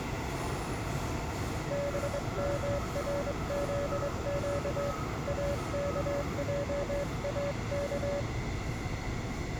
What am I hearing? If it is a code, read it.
Morse code, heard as a keyed tone, hand-sent with a straight key, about 23 wpm, 570 Hz, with the noise inside a subway train. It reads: BMRZQ AKJAK